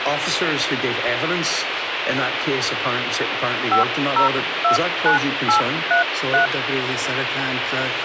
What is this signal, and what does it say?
DTMF, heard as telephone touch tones, dialled by hand, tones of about 120 ms, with radio hiss. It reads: 5029833